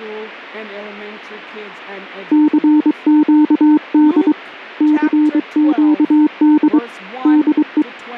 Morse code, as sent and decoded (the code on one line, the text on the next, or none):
-.-. --.- -.. / -.-. --.- -.. / -.. .
CQD CQD DE